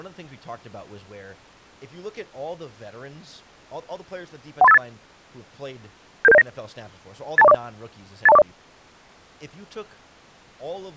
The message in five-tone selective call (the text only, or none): 13858 77709 82040 82040